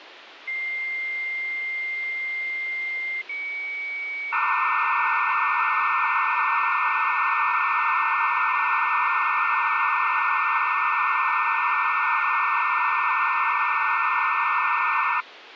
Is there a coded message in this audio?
Yes: dial-up modem handshake (low-speed, two carriers) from 0.5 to 15.2 s, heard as two whistles, then hiss, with phone line noise.